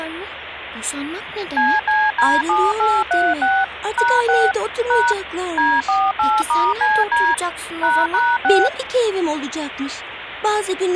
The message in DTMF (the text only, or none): CCD7836 #6 # D48*CD ##6